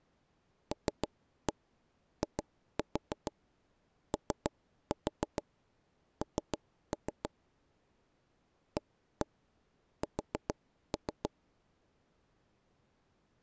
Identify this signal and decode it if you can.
Tap code, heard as knocks on wood, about 6 knocks a second. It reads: LION AS